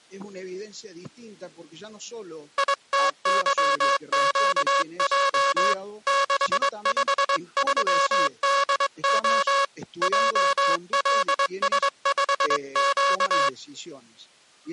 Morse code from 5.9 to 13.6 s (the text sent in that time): 653DO JLS5Q